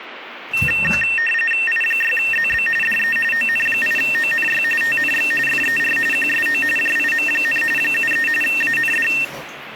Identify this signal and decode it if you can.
RTTY (45.45 baud, 850 Hz shift), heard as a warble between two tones, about 2250 Hz centre, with radio static and the noise of a restroom. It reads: I6ZB DE ON8ONY TNX FER QSO JIM, 73 AND